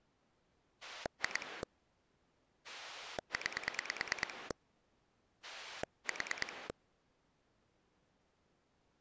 Pulse dialling, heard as a rotary dial, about 9 pulses a second. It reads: 2 9 4